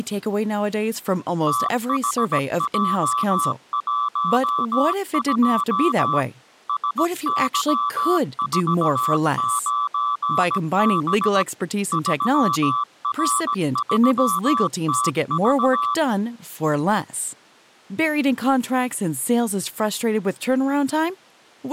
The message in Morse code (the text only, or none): THJ12 SY49B 3R3TV